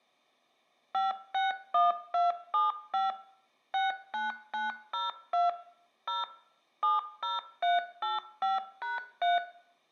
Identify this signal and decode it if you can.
DTMF, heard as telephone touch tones, dialled by machine, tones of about 160 ms, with room echo. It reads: 561275 69902 0 70385#3